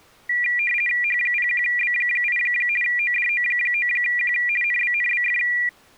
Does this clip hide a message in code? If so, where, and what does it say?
Yes: RTTY (50 baud, 450 Hz shift) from 0.3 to 5.7 s, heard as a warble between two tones, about 2150 Hz centre. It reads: H01B8 ODO9Q NBNBF